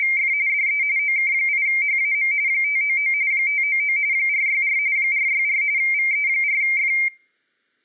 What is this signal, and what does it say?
RTTY (45.45 baud, 170 Hz shift), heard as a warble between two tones, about 2200 Hz centre, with room echo. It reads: … DE OK8HAM 599 599 464 464 VE4F